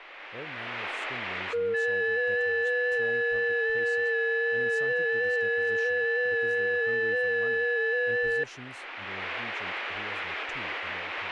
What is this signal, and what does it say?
FT8 (several signals at once), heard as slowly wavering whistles, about 6.25 baud, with speech in English.